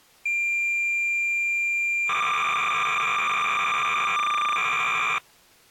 Cassette data (Kansas City type), 300 baud, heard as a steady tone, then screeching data.